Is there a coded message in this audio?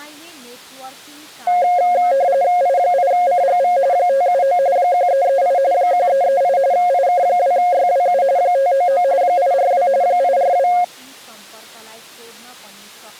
Yes: RTTY (45.45 baud, 170 Hz shift) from 1.5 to 10.8 s, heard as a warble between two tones, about 630 Hz centre, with speech in Nepali. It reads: I8CGV 579 1338 1338 IK2YWU 599 842 842